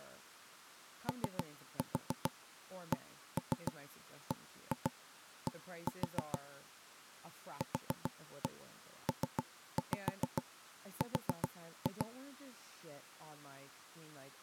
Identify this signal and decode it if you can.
Tap code, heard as knocks on wood, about 7 knocks a second, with speech in English. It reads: OCBD QPR